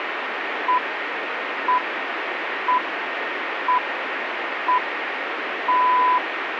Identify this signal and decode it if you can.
Radio time signal (six pips, as the Greenwich Time Signal), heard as pips, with radio static.